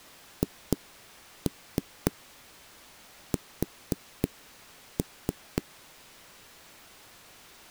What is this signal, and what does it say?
Tap code, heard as knocks on a wall, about 3 knocks a second. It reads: HS